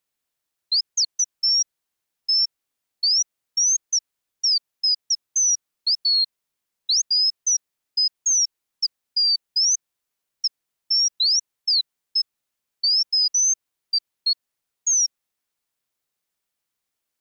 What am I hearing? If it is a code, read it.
Bird-like chirps. There is no code.